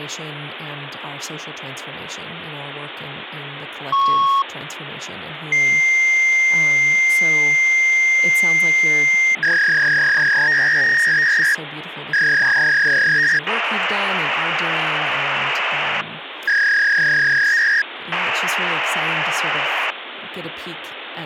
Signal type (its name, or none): fax machine handshake